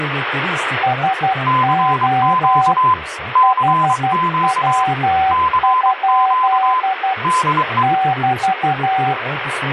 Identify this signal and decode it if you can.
Morse code, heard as two keyed tones, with radio static and speech in Turkish. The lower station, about 12 wpm, 760 Hz: SO HW? <BT>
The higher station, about 23 wpm, 1020 Hz: CQ CQ CQ DE